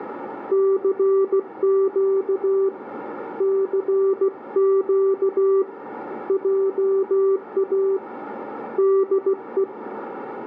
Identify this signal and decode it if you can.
Morse code, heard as a keyed tone, hand-sent with a paddle, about 16 wpm, 390 Hz, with radio static and a narrow filter. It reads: CQ CQ JA DE